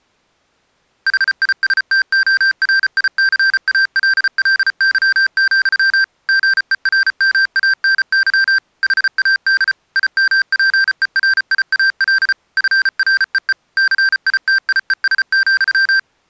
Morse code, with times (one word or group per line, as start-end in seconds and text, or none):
1.1-6.0 HISTORICALLY,
6.3-8.6 GERMANY
8.8-9.7 HAD
10.0-12.3 IMPERIAL
12.6-13.5 FREE
13.8-16.0 CITIES,